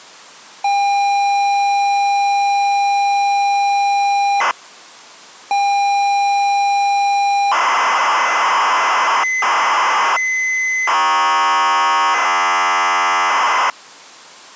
ZX Spectrum tape loading, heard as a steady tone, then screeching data.